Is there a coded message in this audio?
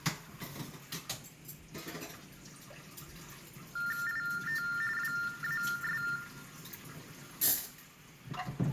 Yes: TTY/TDD text telephone tones (45.45 baud Baudot) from 3.8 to 6.2 s, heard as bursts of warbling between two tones, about 400 Hz shift, 1600 Hz centre, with room echo and kitchen noise. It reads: IT WAS